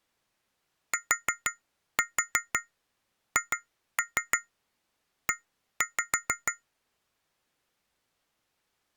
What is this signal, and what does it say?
Tap code, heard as taps on glass, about 6 knocks a second. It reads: THE